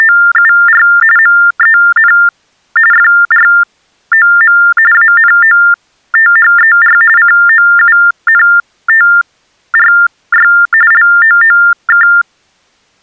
TTY/TDD text telephone tones (45.45 baud Baudot), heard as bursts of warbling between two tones, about 400 Hz shift, 1600 Hz centre. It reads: … MEN FROM ANOTHER COUNTRY LOOK